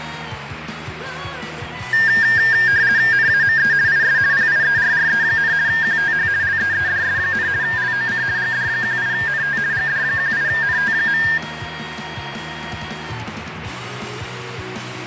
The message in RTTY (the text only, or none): NAME IS PIERRE, QTH LEEDS, LOC GD18NT GD18NT.